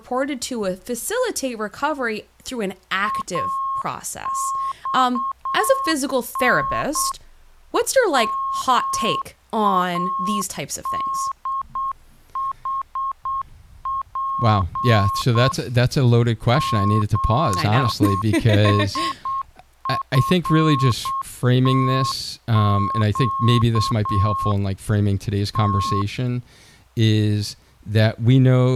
Morse code, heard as a keyed tone, machine-sent, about 8 wpm, 1080 Hz, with speech in English. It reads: AXN MADHP ZSFTQ T